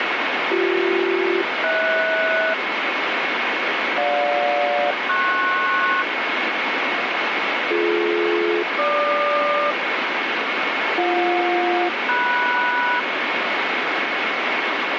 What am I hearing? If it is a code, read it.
Aircraft SELCAL, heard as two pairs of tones, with heavy radio static. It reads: BC-HS GJ-PS BD-GQ BJ-MS